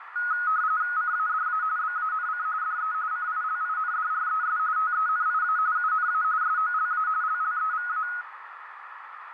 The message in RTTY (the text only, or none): CADA BANC DE CILINDRES TENIA UNA SOLA LLEVA